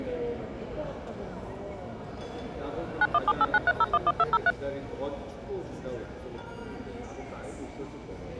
DTMF, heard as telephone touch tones, dialled by machine, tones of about 40 ms, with the noise of a crowd indoors. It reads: 917893011203